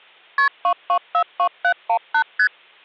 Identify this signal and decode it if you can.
Multi-frequency trunk signalling (R1, as on North American trunks), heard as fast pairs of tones, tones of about 80 ms. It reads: KP 2242718 ST